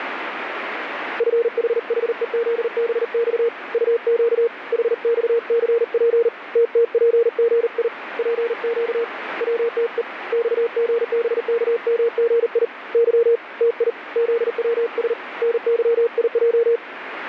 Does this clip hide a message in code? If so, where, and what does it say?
Yes: Morse code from 1.1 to 16.8 s, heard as a keyed tone, hand-sent with a paddle, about 39 wpm, 470 Hz, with radio static. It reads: FHHEZBX UQ HXCP TTPGI PQ WTE XGBKMGI Y TI ZWS NYIJ